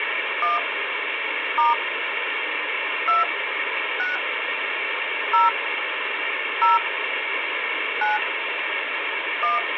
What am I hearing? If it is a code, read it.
DTMF, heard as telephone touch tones, dialled by hand, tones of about 160 ms, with phone line noise. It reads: 1 * 2 6 0 0 9 1